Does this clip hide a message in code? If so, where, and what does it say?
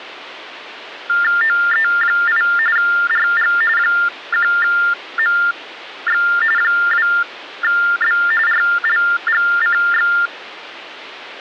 Yes: TTY/TDD text telephone tones (45.45 baud Baudot) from 1.1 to 10.3 s, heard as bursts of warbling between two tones, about 400 Hz shift, 1600 Hz centre. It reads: OE8 RG 1MX 2B RLGCX